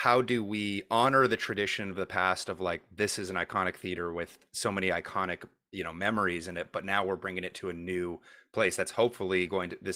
Speech in English. There is no code.